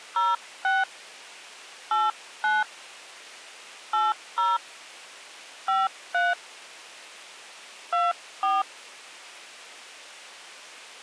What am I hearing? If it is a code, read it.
DTMF, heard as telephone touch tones, dialled by hand, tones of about 190 ms. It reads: 06 89 80 53 24